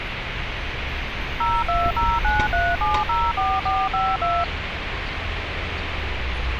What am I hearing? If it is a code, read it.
DTMF, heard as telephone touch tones, dialled by machine, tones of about 230 ms, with radio hiss and street noise. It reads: 02093704452